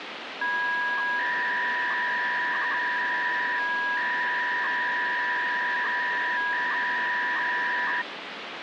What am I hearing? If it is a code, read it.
300-baud modem data (V.21 tones), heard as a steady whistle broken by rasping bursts, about 300 baud, 200 Hz shift, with phone line noise.